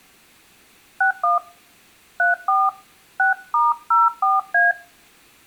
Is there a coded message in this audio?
Yes: DTMF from 1.0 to 4.7 s, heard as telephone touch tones, dialled by hand, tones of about 160 ms, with room echo. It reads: 61 34 6*04A